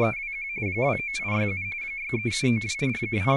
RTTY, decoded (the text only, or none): … 29867 63792 …